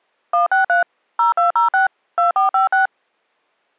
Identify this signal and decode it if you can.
DTMF, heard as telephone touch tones, dialled by machine, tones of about 130 ms. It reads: 163 0206 2456